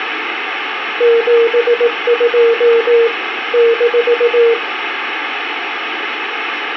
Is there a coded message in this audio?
Yes: Morse code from 0.9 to 4.6 s, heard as a keyed tone, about 18 wpm, 460 Hz, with radio static. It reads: 72 -